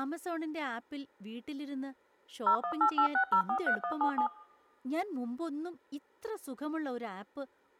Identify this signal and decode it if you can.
DTMF, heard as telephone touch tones, dialled by machine, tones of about 90 ms, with speech in Malayalam. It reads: 01886043177